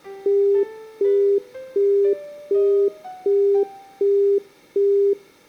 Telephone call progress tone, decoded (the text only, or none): busy tone